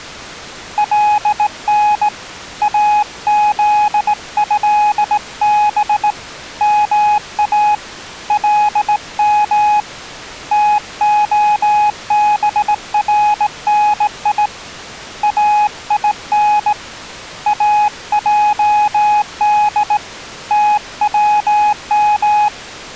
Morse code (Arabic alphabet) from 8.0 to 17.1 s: لم تخبرني اين

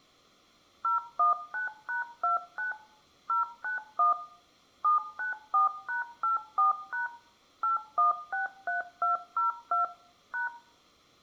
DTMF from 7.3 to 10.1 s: 8163202

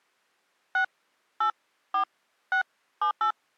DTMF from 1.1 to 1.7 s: 8

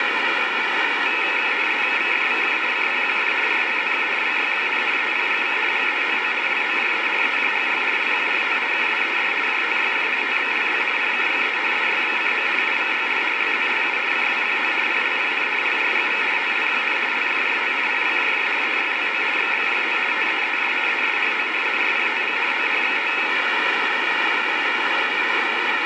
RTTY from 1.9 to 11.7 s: VFVK CPQF RHZK GYQN EPGV GEOO LOJE EJGL LQRT KWED JTYF TMLB PKGE

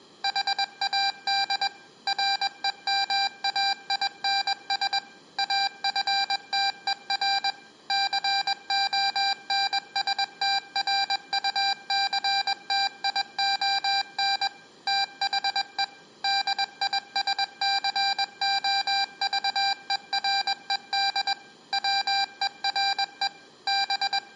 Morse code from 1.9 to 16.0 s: REMAINS AFTER CONSTRUCTION THE

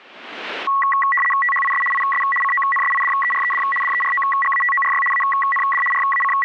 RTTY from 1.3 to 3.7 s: THIS IS CONSIDERED

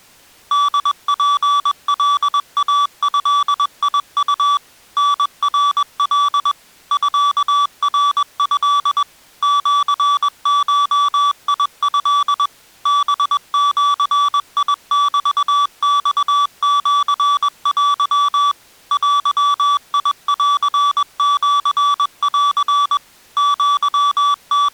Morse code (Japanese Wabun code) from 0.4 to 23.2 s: ホツカイドウ タナカ ミナト シゴト ハジメマシテ デンシン

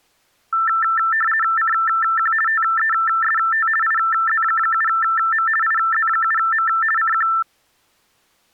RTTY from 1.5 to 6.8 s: CQ TEST IZ7M IZ7M

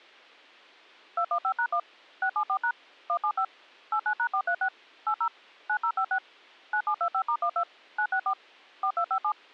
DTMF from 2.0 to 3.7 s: 674# 175

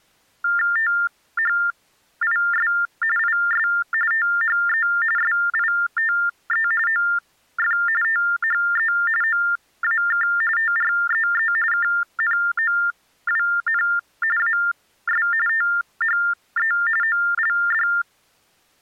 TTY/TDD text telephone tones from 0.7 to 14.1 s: THIS IS THE SITE OF THE OAK TREE KNOWN

